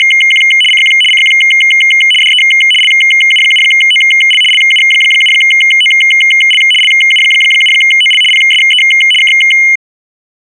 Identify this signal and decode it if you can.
RTTY (75 baud, 850 Hz shift), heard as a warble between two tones, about 2550 Hz centre. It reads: … CQ CQ DE LU7OL LU7OL LU7OL PSE K